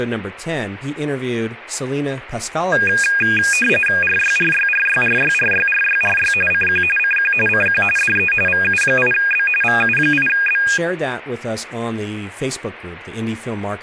RTTY (45.45 baud, 850 Hz shift), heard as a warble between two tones, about 2050 Hz centre, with speech in English. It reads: RYRYRYRYRYRYRY CQ CQ CQ DE VU8B VU8B